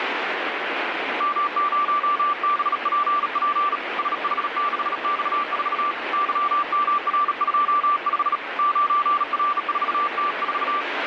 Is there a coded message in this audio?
Yes: Morse code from 1.1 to 10.9 s, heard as a keyed tone, hand-sent with a bug key, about 37 wpm, 1170 Hz, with radio static. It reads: M0BPP SH6X4 YMR25 9R4T4